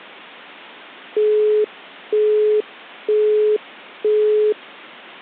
Telephone call progress tone (single-tone plan, as in Europe, Japan and elsewhere), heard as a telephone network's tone, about 420 Hz, 0.48 s on and 0.48 s off. Busy tone.